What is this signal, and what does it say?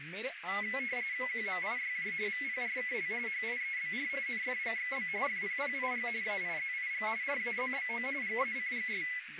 RTTY (45.45 baud, 170 Hz shift), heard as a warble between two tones, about 2100 Hz centre, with radio static, a narrow filter and speech in Punjabi. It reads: QMIYJ VPRKL HIEBR NFGXB FPPIG AIZIG RAZBO GACGS